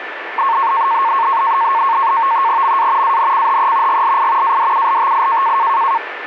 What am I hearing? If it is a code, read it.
NAVTEX (SITOR-B), 100 baud, 170 Hz shift, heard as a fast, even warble, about 1000 Hz centre, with radio static and a steady whistle near 1760 Hz. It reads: MA ANCHE GLI ADULTI